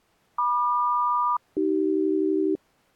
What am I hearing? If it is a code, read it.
Aircraft SELCAL, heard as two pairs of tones. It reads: MQ-AC